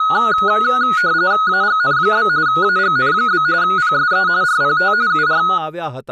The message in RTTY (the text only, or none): AGN? AGN? PSE RPT UR